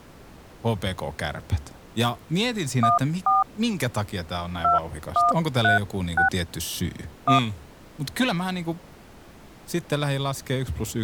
DTMF, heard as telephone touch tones, dialled by hand, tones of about 140 ms, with speech in Finnish. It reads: 14 2136 1